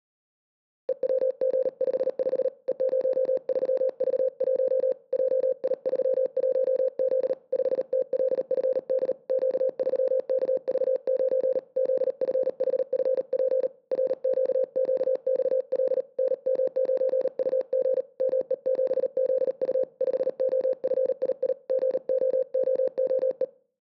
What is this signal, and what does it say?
Morse code, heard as a keyed tone, hand-sent with a paddle, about 38 wpm, 520 Hz. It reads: EWG55 E03V1 JI31Z 5TLFD Q3KV9 ZFHFP RQQXL NM9UG ME7ZU 5OFII GOOOE